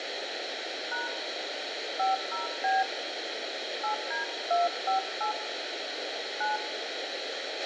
DTMF, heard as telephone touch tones, dialled by hand, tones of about 160 ms, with radio hiss, a squelch burst at the end and room echo. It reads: # 50B 8D258 9